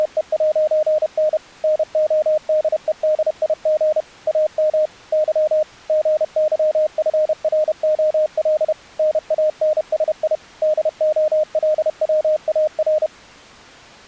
Morse code, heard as a keyed tone, machine-sent, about 31 wpm, 610 Hz. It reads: … NODEDIG AM Y GYFROL NANSI DOLWAR